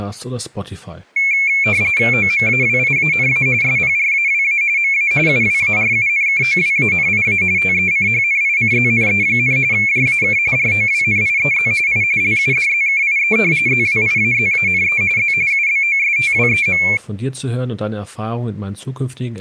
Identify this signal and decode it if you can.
RTTY (45.45 baud, 170 Hz shift), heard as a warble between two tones, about 2300 Hz centre, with speech in German. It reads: OMAWIANA SPRAWA MA UWARUNKOWANIA TECHNICZNE, JAK ROWNIEZ I LUDZKIE ZWIAZANE Z UBOSTWEM